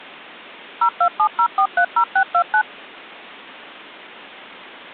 DTMF, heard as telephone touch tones, dialled by machine, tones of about 80 ms. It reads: 0270430629